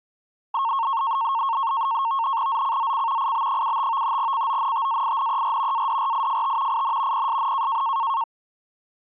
NAVTEX (SITOR-B), 100 baud, 170 Hz shift, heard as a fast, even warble, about 1000 Hz centre. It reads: ZCZC IB75 CONTAINER ADRIFT IN PSN